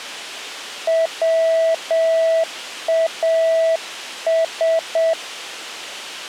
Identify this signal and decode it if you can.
Morse code, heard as a keyed tone, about 7 wpm, 650 Hz. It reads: WAS